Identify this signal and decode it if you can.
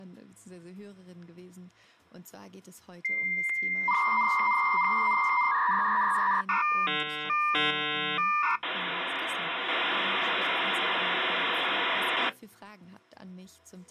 Dial-up modem handshake (V.34 or later), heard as a whistle, warbles, then hiss.